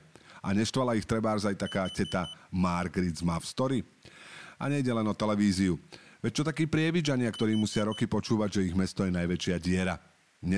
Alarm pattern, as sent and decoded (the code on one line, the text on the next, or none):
4 beeps and a pause
temporal four